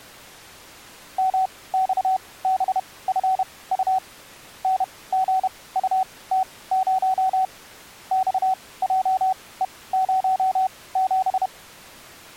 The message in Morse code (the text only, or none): MXBFU NGUT0 XJE07